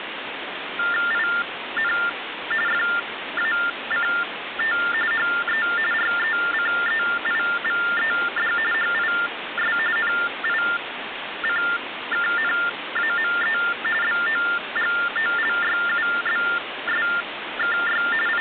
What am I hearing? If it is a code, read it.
TTY/TDD text telephone tones (45.45 baud Baudot), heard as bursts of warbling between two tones, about 400 Hz shift, 1600 Hz centre, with phone line noise. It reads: IN FACT HE RECEIVED HIS NICKNAME BOGOLYUBSKY …